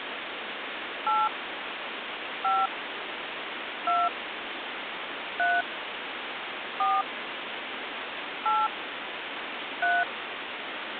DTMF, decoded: 8 5 2 3 4 8 3

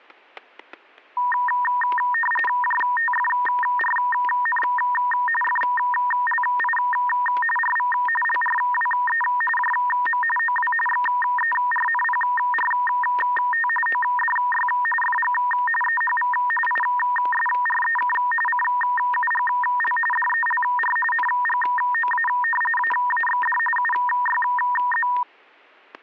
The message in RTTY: JTFRN FLI RV LRWE JM OW XERNPRT ODY FG EHV ISREK CUGL DELR NGOA AAXD UYZ

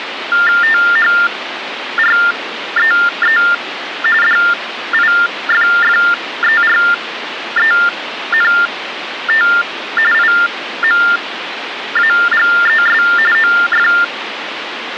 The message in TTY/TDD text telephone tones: THREE DIFFERENT IMAGES OF

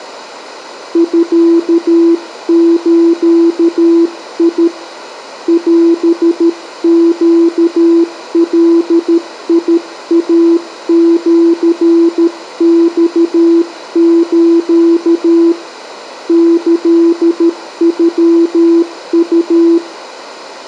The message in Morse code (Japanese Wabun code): ミズ オネガイシマス キノウ

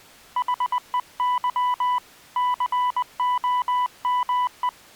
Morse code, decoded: HEY COME

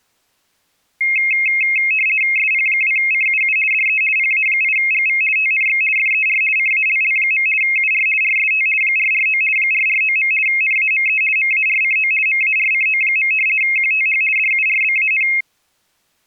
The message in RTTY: SP2CUU DE PA8GV TNX FER CALL. UR RST 449 449. NAME MARCO MARCO. QTH DURBAN

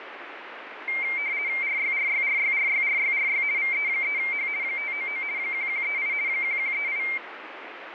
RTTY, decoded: RYRYRYRYRYRY VE3H 599 1138 1138

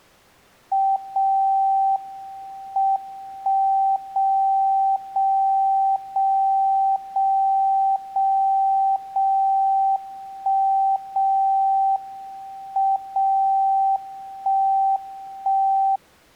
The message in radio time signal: 0 M 1 0 0 0 0 0 0 1 0 M 0 1 1

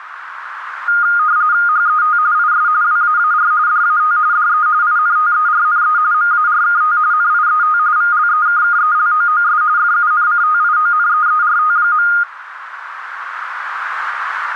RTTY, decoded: HET IS WAAR DAT DE INTERNE MARKT NIET VLEKKELOOS FUNCTIONEERT.

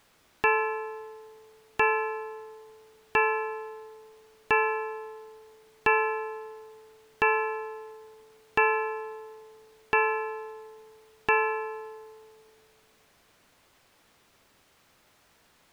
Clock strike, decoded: 9

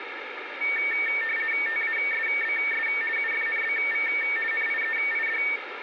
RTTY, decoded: TASBS UFNBV NIEID

